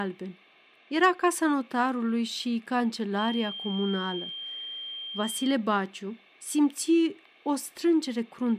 A steady tone, with speech in Romanian. There is no code.